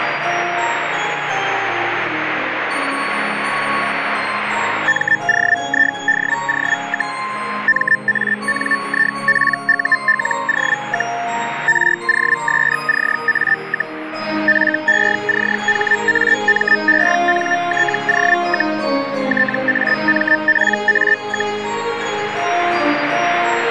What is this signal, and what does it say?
Hellschreiber (Feld-Hell, 122.5 baud), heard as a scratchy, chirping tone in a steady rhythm, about 1800 Hz, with radio static. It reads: MOIDO, MANIPULO, ROSCA, FECHAMENTO, TAMPA,